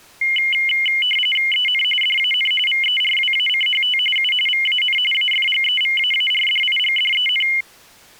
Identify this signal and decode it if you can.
RTTY (45.45 baud, 850 Hz shift), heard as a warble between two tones, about 2550 Hz centre. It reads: EN DAN VERWACHT U VAN AFGEVAARDIGDEN